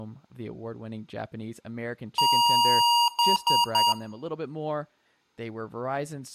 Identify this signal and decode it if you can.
Beep code, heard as beeps from a small speaker, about 950 Hz, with room echo and speech in English. 1 long, 3 short. In Award and IBM BIOS tables: video adapter failure; in AMI BIOS tables: memory failure.